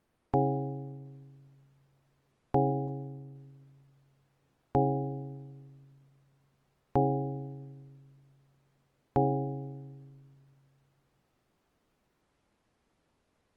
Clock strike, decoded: 5

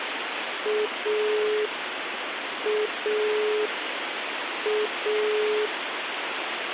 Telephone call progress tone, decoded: dial tone

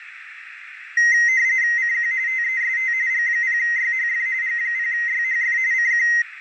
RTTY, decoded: CQ TEST G0YHF G0YHF CQ

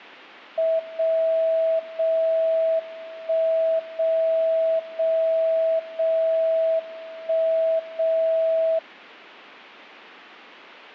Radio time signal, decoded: 0 0 1 0 0 0 1 0

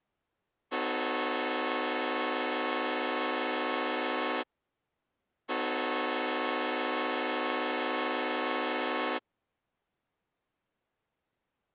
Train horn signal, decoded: 2 long

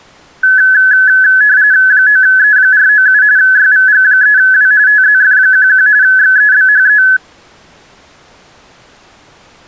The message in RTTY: 9E497 YVG3W TZF11 XEBHE

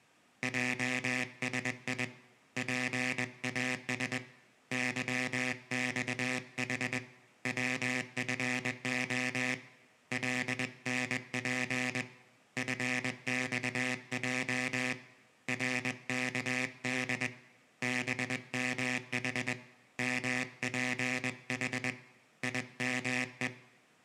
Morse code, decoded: JSI PAS YXH WFO LNP FXJ RKD BMH MPH IME

